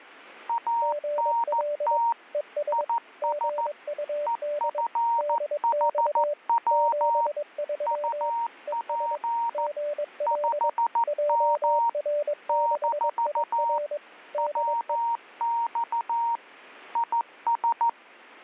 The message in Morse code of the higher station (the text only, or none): ANT IS EFHW UP 5M - WX IS